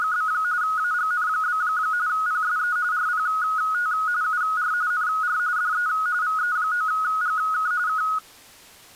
RTTY (45.45 baud, 170 Hz shift), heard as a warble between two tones, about 1360 Hz centre. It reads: … AGN? PSE RPT UR NR DE VE9GK K